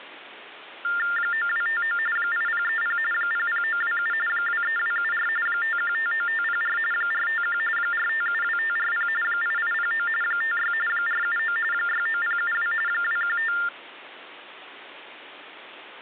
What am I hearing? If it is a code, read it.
TTY/TDD text telephone tones (45.45 baud Baudot), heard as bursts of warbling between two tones, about 400 Hz shift, 1600 Hz centre. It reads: 9259 8030 00927 23274 5159504 451 4572540 8809 56 479 69072 215